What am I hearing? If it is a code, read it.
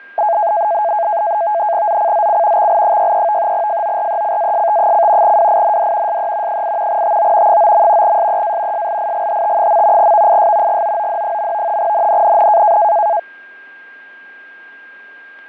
NAVTEX (SITOR-B), 100 baud, 170 Hz shift, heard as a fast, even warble, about 760 Hz centre, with fading, static crashes and a steady whistle near 1610 Hz. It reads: ZCZC XL63 FORECAST: WIND SE 8 TO 9. SEA SLIGHT. VIS GOOD. NNNN